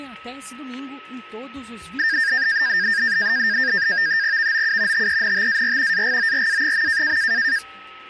NAVTEX (SITOR-B), 100 baud, 170 Hz shift, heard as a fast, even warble, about 1700 Hz centre, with static crashes and a steady whistle near 1290 Hz. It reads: VOU TENTAR AGORA.